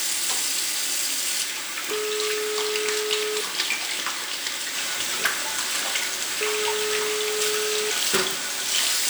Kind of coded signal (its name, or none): telephone call progress tone